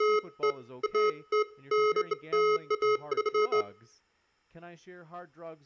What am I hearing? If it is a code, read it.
Beeps of irregular length, with room echo and speech in English. There is no code.